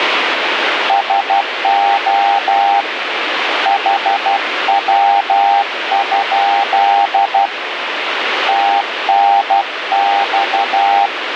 Morse code, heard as a keyed tone, hand-sent with a paddle, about 12 wpm, 800 Hz, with radio static. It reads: SO HW? TNX